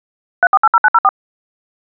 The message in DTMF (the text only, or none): 3480904